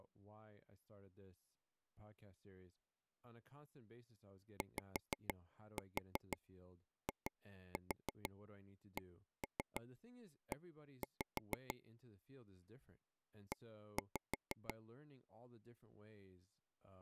Tap code, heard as taps on a table, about 6 knocks a second, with speech in English. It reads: YICE E